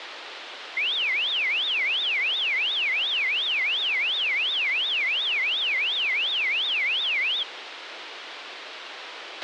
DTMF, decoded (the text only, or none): none